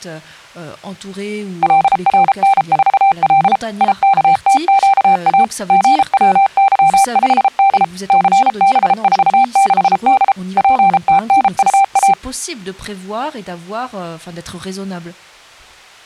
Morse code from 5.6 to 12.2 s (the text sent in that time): GWY5D CB46D PTNUA